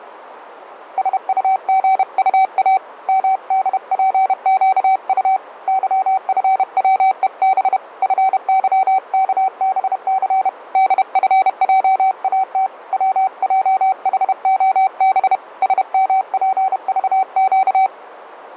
Morse code, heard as a keyed tone, hand-sent with a paddle, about 31 wpm, 760 Hz, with radio static. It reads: SUGUA MDPQU YFWEB FYKBC DFJAT WJHOB SMPVQ